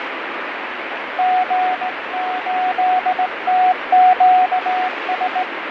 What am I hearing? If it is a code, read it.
Morse code, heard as a keyed tone, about 18 wpm, 740 Hz, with radio static and fading. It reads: G8TQS